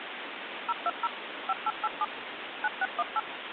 DTMF, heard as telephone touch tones, dialled by machine, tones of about 40 ms, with phone line noise. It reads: 020 5887 9618